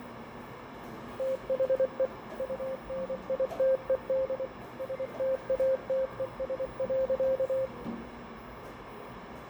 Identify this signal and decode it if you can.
Morse code, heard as a keyed tone, machine-sent, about 24 wpm, 530 Hz, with radio static, fading, a narrow filter and the noise of a cafe. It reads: THE UNITED STATES.